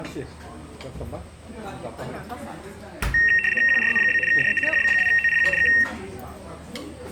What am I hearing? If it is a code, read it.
RTTY (75 baud, 850 Hz shift), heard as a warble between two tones, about 2300 Hz centre, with the noise of a restaurant. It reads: QRZ? DE HB2OPQ K